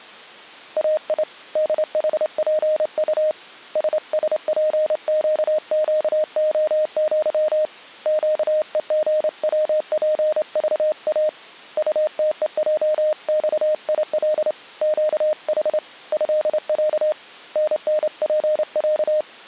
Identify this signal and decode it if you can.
Morse code (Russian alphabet), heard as a keyed tone, hand-sent with a straight key, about 28 wpm, 620 Hz. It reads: АИ ДХПУ ССПЩЩОЪ ЩЕГВПЖА УТЕЙЬИЛ ЩХ ЭЯ ННПЯ